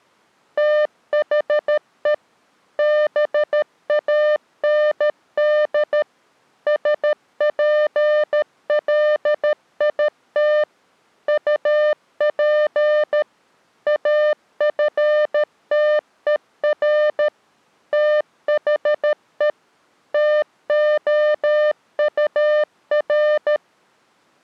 Morse code, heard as a keyed tone, machine-sent, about 13 wpm, 600 Hz. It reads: THE BAND SPLIT UP AFTER THE TOUR